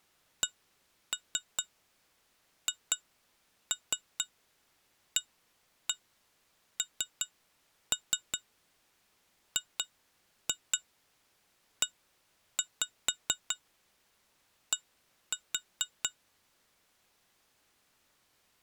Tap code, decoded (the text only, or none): CHANGED